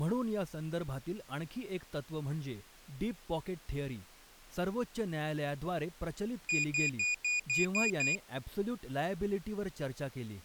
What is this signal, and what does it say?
Beep code, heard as a piezo beeper, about 2450 Hz, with speech in Marathi. 7 short. In AMI BIOS tables: virtual mode exception error; in Dell tables: processor failure.